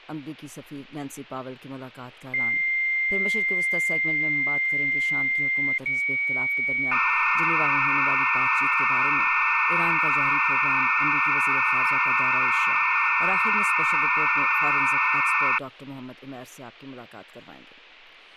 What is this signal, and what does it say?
Dial-up modem handshake (low-speed, two carriers), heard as two whistles, then hiss.